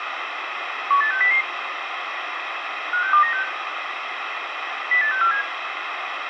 Five-tone selective call (CCIR), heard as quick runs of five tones, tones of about 100 ms, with radio hiss, a squelch burst at the end and room echo. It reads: 18600 56296 08647